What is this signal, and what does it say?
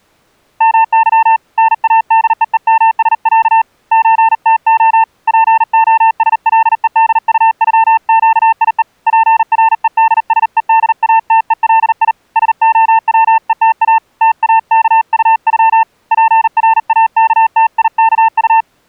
Morse code (Russian alphabet), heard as a keyed tone, hand-sent with a paddle, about 39 wpm, 900 Hz. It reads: МЫ НАДЕЕМСЯ ЧТО ПОСЛЕДУЮЩИЕ ПРЕДСЕДАТЕЛИ СОВЕТА ТАКУЮ ПРАКТИКУ